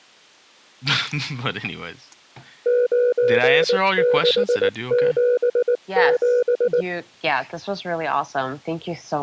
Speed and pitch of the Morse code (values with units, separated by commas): 19 wpm, 490 Hz